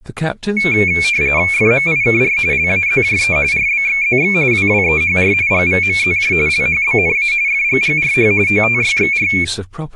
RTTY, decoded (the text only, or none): FMIKR LAZJE RBXZX WWEHR GVMZJ LHBNA FGGRH OTYXR